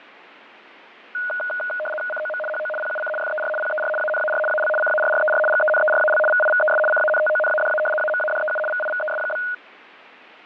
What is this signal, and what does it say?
RTTY (75 baud, 850 Hz shift), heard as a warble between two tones, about 1040 Hz centre, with radio static and fading. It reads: COM HO PUC FER PER ANAR AL CARRER GENERAL VIVES CANTONADA AMADEU VIVES?